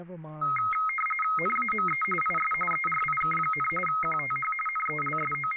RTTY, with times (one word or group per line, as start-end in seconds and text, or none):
1.4-2.0 NAME
2.2-2.5 IS
2.7-3.7 ERIK,
3.9-4.5 QTH
4.7-5.6 …